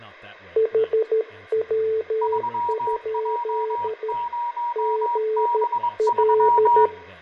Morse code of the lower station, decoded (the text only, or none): HW? GL